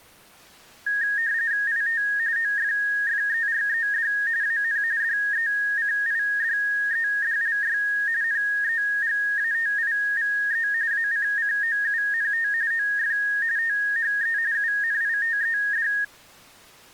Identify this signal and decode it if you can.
RTTY (45.45 baud, 170 Hz shift), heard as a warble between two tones, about 1750 Hz centre. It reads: IT OFFERED AN DECIDEDLY NEGATIVE ACCOUNT OF THE UNITED